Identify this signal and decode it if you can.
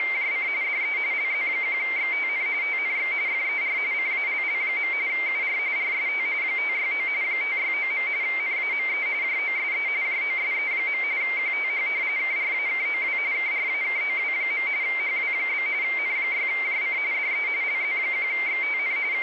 RTTY (45.45 baud, 170 Hz shift), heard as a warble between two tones, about 2200 Hz centre, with radio static. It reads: … DE LZ1XTN TNX FER CALL. UR RST 569 569. NAME JOSE JOSE. QTH KRAKOW KRAKOW. HW? N6JC DE LZ1XTN …